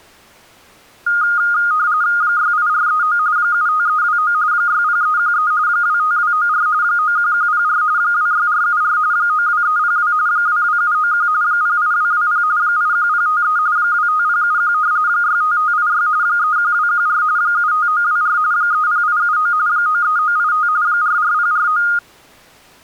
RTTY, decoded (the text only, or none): 68439 75329 60313 25294 91104 26474 92302 22791 08220 81053 25071 65586 31214 75924 30879 93985 44049